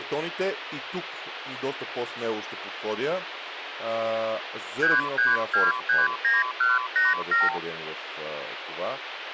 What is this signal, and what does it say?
Multi-frequency trunk signalling (R2, with the far end's replies), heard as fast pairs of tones, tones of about 180 ms, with phone line noise and speech in Bulgarian. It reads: 33239187